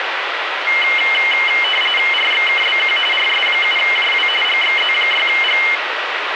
RTTY (45.45 baud, 850 Hz shift), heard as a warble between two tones, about 2550 Hz centre, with radio static. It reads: RXKBQ RS7JW GXZ6G